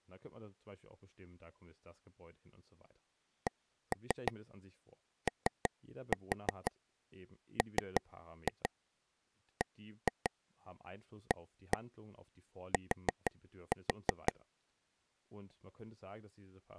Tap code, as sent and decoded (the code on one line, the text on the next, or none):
1-3 3-4 3-2 1-2 1-1 4-4
COMBAT